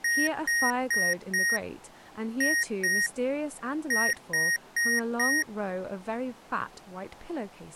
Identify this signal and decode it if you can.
Beep code, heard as beeps from a small speaker, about 1850 Hz, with speech in English. 4-2-4. In Phoenix BIOS tables: unexpected interrupt in protected mode.